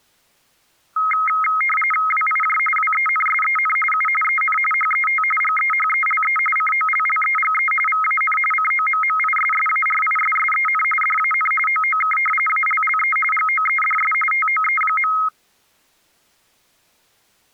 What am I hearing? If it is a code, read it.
RTTY (45.45 baud, 850 Hz shift), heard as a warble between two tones, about 1700 Hz centre. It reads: WIJ WENSEN U EN HET GEHELE COLLEGE VAN COMMISSARISSEN DAN OOK ALLE GOEDS TOE.